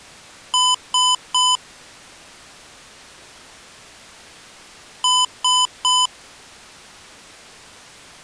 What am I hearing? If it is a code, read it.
Beep code, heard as beeps from a small speaker, played twice, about 1000 Hz. 3 short. In AMI BIOS tables: failure in the first 64 KB of memory; in Dell tables: chipset error.